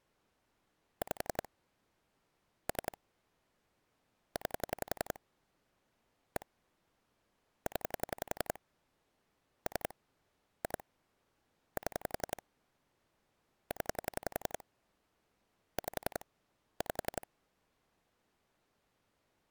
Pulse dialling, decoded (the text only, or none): 5 3 9 1 0 3 2 7 0 5 5